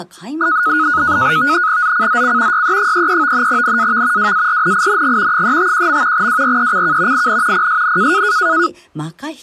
NAVTEX (SITOR-B), 100 baud, 170 Hz shift, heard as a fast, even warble, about 1360 Hz centre, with speech in Japanese. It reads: ZCZC YE33 NAV WARNING 351. WRECK IN PSN